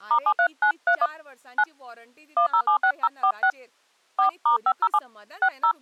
DTMF, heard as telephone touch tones, dialled by hand, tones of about 80 ms, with speech in Goan Konkani. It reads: *73931 9 1076046 4*507 60